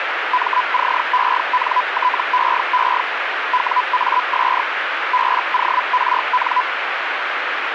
Hellschreiber (Feld-Hell, 122.5 baud), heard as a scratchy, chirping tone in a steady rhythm, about 1000 Hz, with radio static. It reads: MCENTEE WAS BORN